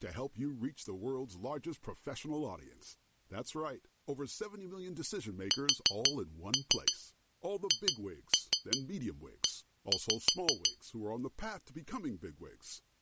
Tap code, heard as taps on glass, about 6 knocks a second, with speech in French. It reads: SHE